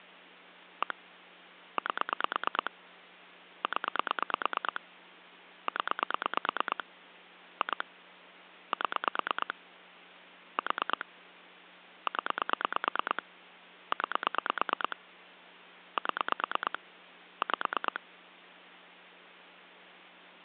Pulse dialling, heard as clicks on a phone line, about 9 pulses a second, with phone line noise. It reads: 1 8 0 0 2 7 4 0 9 7 5